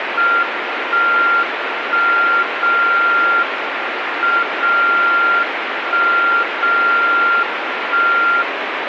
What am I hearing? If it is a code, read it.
Radio time signal (WWVB), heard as a tone whose level steps once a second, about 1390 Hz, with radio static. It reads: 1 1 0 M 0 1 0 1